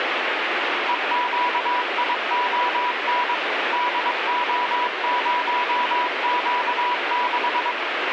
Morse code, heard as a keyed tone, machine-sent, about 22 wpm, 980 Hz, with radio static. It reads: EQION DO0Q6